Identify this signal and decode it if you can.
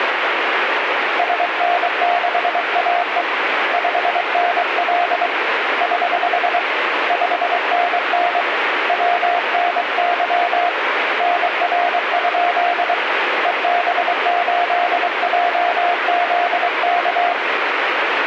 Morse code, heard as a keyed tone, hand-sent with a paddle, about 23 wpm, 700 Hz, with radio static. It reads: SN6AE 5NL <HH> 5NN WNY NR? EB8JZK